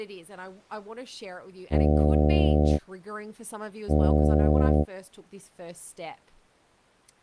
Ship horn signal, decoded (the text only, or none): 2 short